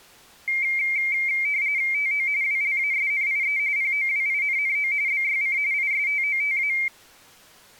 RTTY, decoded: TO WLASNIE POWINNO BYC ISTOTA

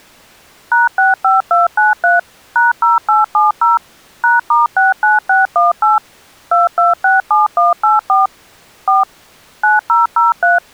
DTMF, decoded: #65293 #0870 #*69618 2267184 4 9003

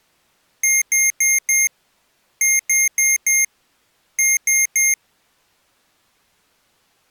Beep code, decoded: 4-4-3

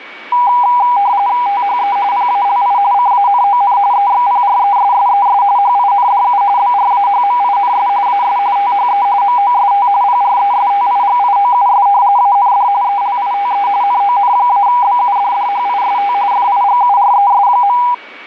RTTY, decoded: THE PALI CANON EXPRESSES HINDU BRAHMINS AS THE MOST PRESTIGIOUS AND ELITE NON-BUDDHIST FIGURES.

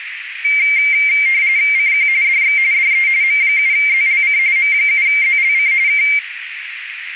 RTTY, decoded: CQ DX DE M7ZLC M7ZLC K

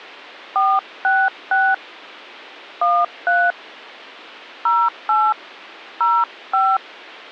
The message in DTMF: 466 13 08 05

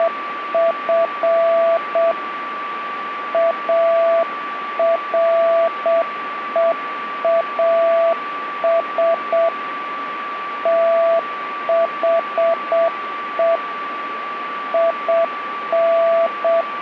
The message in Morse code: … AREAS THE IN

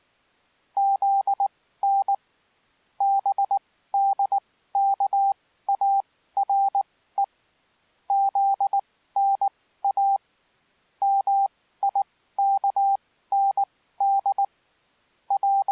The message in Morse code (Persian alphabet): زن بدکاره زنا میکند …

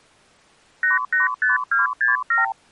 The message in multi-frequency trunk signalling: 885267

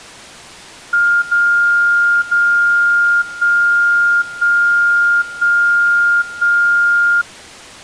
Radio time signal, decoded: 0 0 1 1 1 1

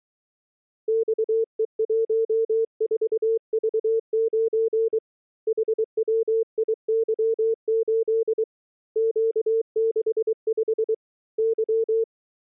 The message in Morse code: XE14V9 HWIY8 Q65 Y

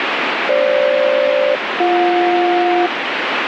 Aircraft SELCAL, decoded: FG-BJ

